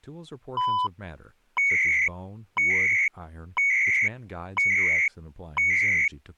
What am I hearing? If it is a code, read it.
Radio time signal (CHU, Canada), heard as beeps and data bursts, one a second, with speech in English.